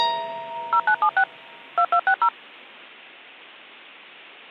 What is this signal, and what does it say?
DTMF, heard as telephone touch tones, dialled by machine, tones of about 70 ms. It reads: 0976 2260